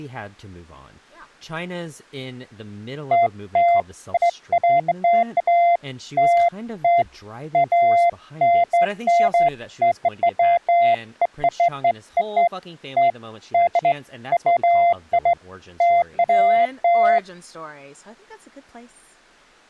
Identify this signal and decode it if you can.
Beeps of irregular length, with speech in English. There is no code.